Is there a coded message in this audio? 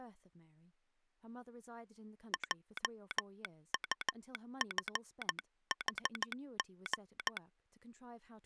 Yes: Morse code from 2.3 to 7.4 s, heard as a telegraph sounder, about 14 wpm, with speech in English. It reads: JUFHG